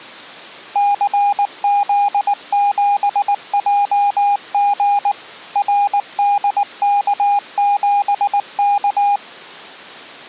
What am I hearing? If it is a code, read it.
Morse code, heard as a keyed tone, machine-sent, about 19 wpm, 810 Hz. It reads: CZ7JG RDK7K